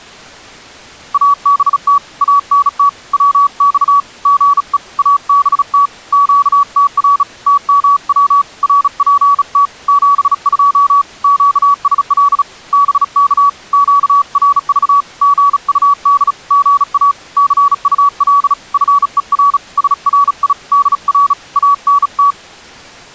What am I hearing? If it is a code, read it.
Morse code, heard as a keyed tone, hand-sent with a bug key, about 36 wpm, 1140 Hz. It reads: ABT ANT WX GE ABT QTR TMW RPT 72 QSL BK QRV GUD GA CUL FER SRI DR ANT